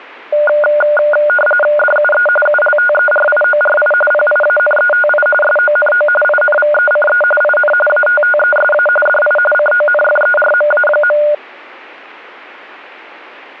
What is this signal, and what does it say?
RTTY (45.45 baud, 850 Hz shift), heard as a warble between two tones, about 1020 Hz centre. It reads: DUE ULTERIORI PIANETI SONO INVECE IN ATTESA DI CONFERMA.